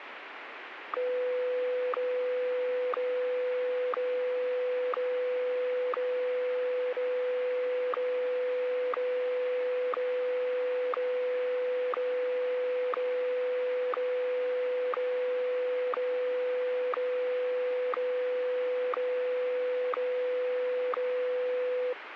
Radio time signal (WWVH, Hawaii), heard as ticks, one a second, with radio static.